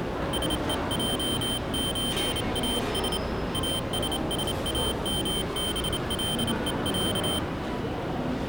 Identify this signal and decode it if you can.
Morse code (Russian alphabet), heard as a high beeper, hand-sent with a straight key, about 28 wpm, 3100 Hz, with the noise of a crowd indoors. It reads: СЕЙЧАС АССАМБЛЕЯ